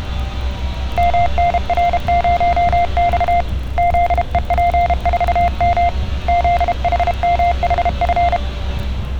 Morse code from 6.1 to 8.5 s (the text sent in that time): ZHMHF